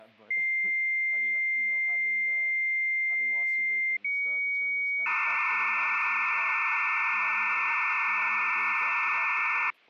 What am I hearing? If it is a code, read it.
Dial-up modem handshake (low-speed, two carriers), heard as two whistles, then hiss, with speech in English.